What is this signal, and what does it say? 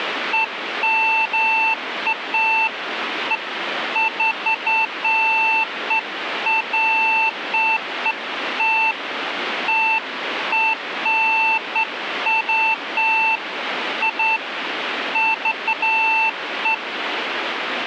Beeps of irregular length, with radio static. There is no code.